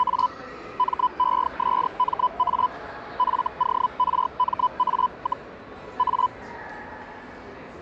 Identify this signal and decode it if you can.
Hellschreiber (Feld-Hell, 122.5 baud), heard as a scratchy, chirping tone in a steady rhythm, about 1000 Hz, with the noise of a crowd indoors. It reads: … MESMA FORMA, A